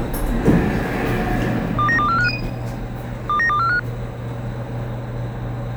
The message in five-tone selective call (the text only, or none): 29245 29245